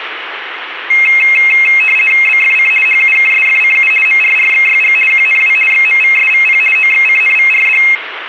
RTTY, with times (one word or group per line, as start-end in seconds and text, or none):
2.3-2.7 BFC
2.9-3.9 HUKSFCU
4.1-5.0 MRRXYG
5.1-5.6 QNW
5.7-6.6 XMVSVP
6.8-7.8 OXCNVRD